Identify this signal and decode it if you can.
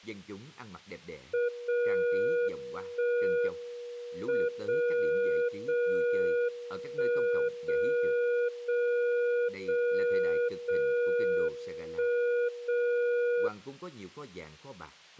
Radio time signal (WWVB), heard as a tone whose level steps once a second, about 480 Hz, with speech in Vietnamese. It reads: 0 1 M 0 0 1 0 0 0 0 1 0